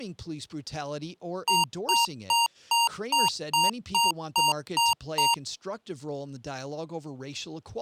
Beep code, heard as beeps from a small speaker, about 930 Hz, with speech in English. 10 short. In AMI BIOS tables: CMOS shutdown register error.